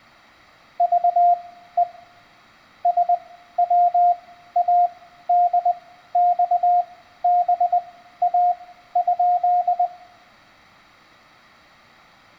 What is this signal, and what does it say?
Morse code (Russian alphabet), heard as a keyed tone, machine-sent, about 20 wpm, spaced as for 13 wpm, 710 Hz, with room echo. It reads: ЖЕ СВАДЬБА?